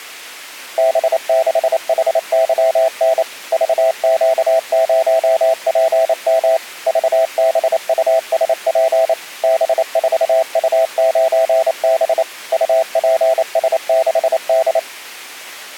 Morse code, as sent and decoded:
-... -.... .... -.-- -. / ...- --.- ----- .--. -- / ...- -... ..- ... .--. / -... ....- ..- ----. -... / ..- .--. ... -.... -..
B6HYN VQ0PM VBUSP B4U9B UPS6D

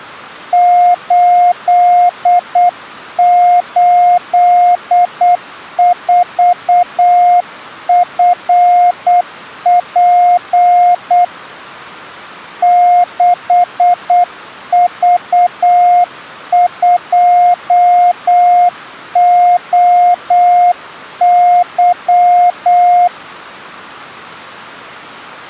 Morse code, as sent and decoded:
---.. ---.. ....- ..-. .--. / -.... ...- ..--- --- -.--
884FP 6V2OY

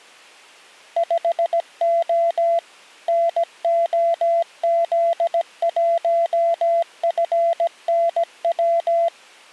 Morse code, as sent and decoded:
..... --- / -. --- --.. .---- ..-. -. .--
5O NOZ1FNW

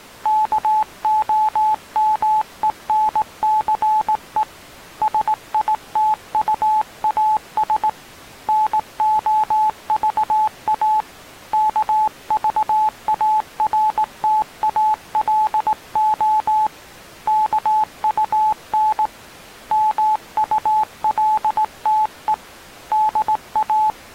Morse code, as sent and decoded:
-.- --- -- . -. -.-. . / ... .. - ..- .- ... / -. --- ...- .- / -.- ...- .- .-. - .- .-.. --- / -.- ..- -. / -- ..- .-.. - . / -.. .-
KOMENCE SITUAS NOVA KVARTALO KUN MULTE DA

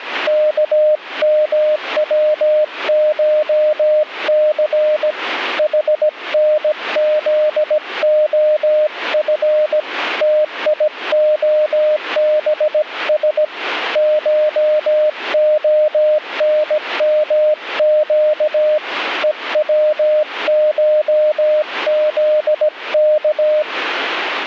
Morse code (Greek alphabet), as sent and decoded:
-.- -- .-- ---- -.-. / .... -. --.. --- ..-. / - .. --- -... ... / ---- --- -. -- --.- / . .-- ---- --.. -.-
ΚΜΩΧΘ ΗΝΖΟΦ ΤΙΟΒΣ ΧΟΝΜΨ ΕΩΧΖΚ

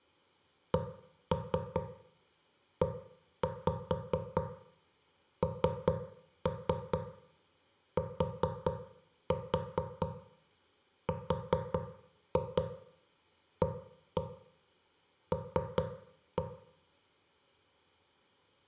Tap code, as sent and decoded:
1-3 1-5 3-3 4-4 4-2 1-1 3-1
CENTRAL

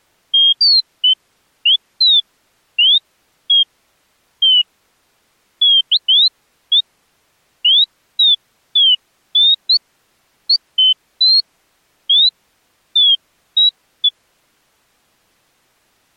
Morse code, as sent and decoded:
none

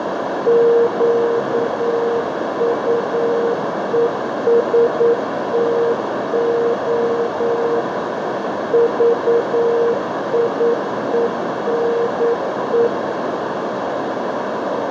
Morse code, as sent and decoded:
--.- ..- . ... - --- / ...- .. . -. .
QUESTO VIENE

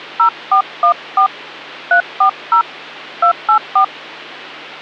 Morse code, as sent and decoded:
none

